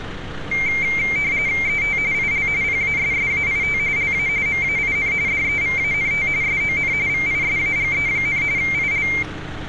RTTY (45.45 baud, 170 Hz shift), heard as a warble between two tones, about 2200 Hz centre, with street noise. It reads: ET IL PASSAIT LA MAIN DEVANT SON VISAGE, IL